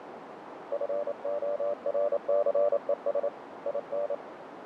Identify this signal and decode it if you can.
Morse code, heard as a keyed tone, hand-sent with a paddle, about 28 wpm, 580 Hz, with radio static and a narrow filter. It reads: FORCES IN